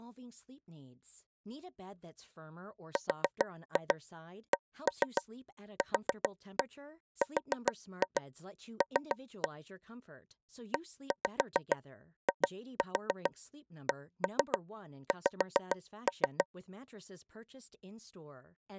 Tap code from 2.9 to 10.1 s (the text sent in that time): RCQRL